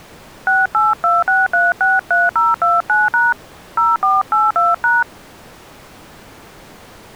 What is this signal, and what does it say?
DTMF, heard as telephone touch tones, dialled by hand, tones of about 190 ms. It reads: 6826363029# 0482#